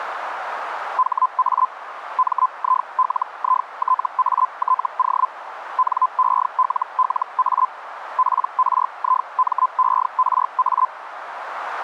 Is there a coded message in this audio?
Yes: Hellschreiber (Feld-Hell, 122.5 baud) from 1.0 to 10.9 s, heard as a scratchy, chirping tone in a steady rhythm, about 1020 Hz, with radio static. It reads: HA MILITATO NELLA PRIMERA